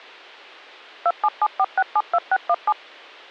DTMF, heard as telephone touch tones, dialled by machine, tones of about 50 ms. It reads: 2774672617